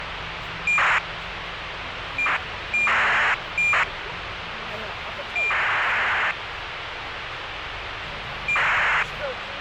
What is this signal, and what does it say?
ACARS aircraft data, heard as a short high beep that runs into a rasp, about 2400 baud, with radio hiss and the noise inside a car.